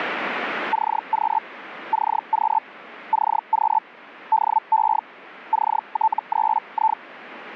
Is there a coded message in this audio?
Yes: Hellschreiber (Feld-Hell, 122.5 baud) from 0.7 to 7.0 s, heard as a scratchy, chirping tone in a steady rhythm, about 880 Hz, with radio static. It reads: CQ CQ CQ DE CT3I